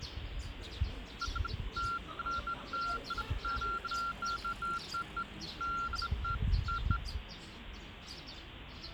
Beeps of irregular length, with the noise of a park. There is no code.